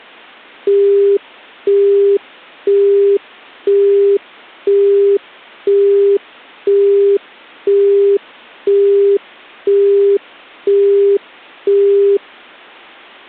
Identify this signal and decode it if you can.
Telephone call progress tone (single-tone plan, as in Europe, Japan and elsewhere), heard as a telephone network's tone, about 400 Hz, 0.5 s on and 0.5 s off. Busy tone.